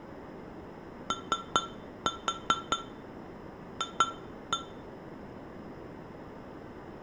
Tap code, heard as taps on glass, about 5 knocks a second, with room echo. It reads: OF